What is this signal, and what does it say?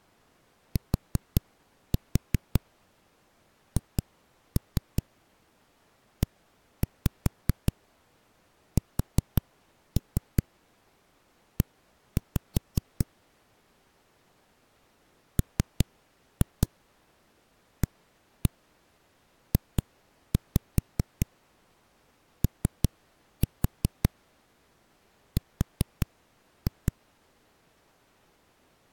Tap code, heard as knocks on a wall, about 5 knocks a second. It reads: THESE MAJOR